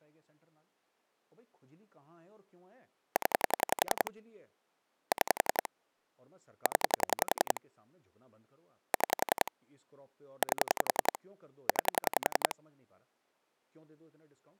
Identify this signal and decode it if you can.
Pulse dialling, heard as clicks on a phone line, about 11 pulses a second, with speech in Urdu. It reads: 0 6 0 6 8 9